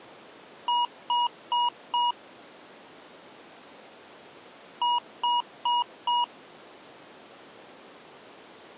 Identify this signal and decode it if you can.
Beep code, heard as beeps from a small speaker, played twice, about 960 Hz. 4 short. In AMI BIOS tables: system timer failure; in Dell tables: memory read or write failure.